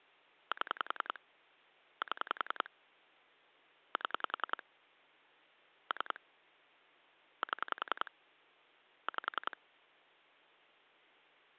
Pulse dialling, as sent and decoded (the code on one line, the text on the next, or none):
7 / 7 / 7 / 3 / 7 / 5
7 7 7 3 7 5